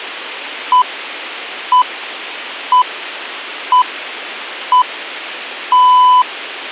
Radio time signal (six pips, as the Greenwich Time Signal), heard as pips.